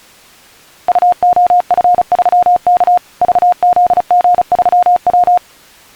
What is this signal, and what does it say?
Morse code, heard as a keyed tone, machine-sent, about 35 wpm, 710 Hz. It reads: UOF3K VZG3W